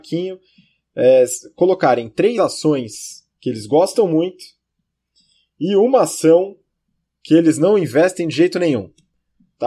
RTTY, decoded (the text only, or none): none